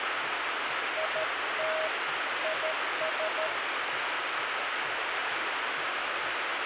Morse code, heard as a keyed tone, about 13 wpm, 630 Hz, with heavy radio static and the noise of a cafe. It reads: IT IS